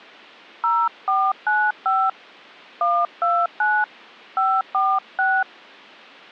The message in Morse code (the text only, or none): none